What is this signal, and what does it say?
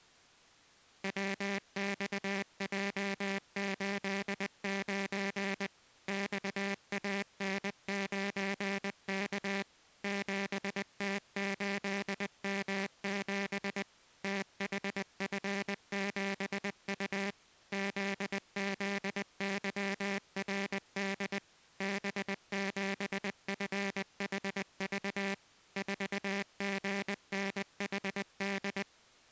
Morse code, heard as a buzzer, machine-sent, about 20 wpm. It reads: WXJ89 XAN9K 7T8M7 THF7U ZZYRD B7FHV 4GNHD